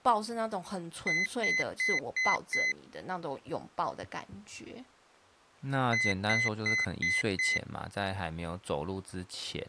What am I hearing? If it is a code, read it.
Beep code, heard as a piezo beeper, played twice, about 2050 Hz, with speech in Chinese. 5 short. In AMI BIOS tables: processor failure; in Dell tables: CMOS battery failure.